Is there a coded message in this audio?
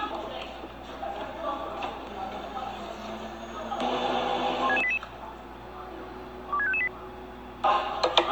Yes: five-tone selective call (ZVEI) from 4.6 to 6.9 s, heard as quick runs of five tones, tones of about 70 ms, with the noise of a cafe. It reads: 16688 26558